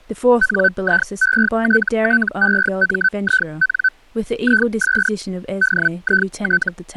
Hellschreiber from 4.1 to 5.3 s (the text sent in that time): IS